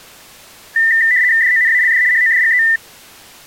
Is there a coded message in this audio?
Yes: RTTY (75 baud, 170 Hz shift) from 0.8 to 2.8 s, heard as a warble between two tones, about 1900 Hz centre. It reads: DONALD HODGE